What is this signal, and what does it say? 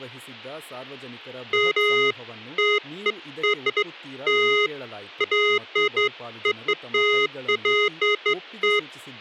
Beeps of irregular length, with speech in Kannada. There is no code.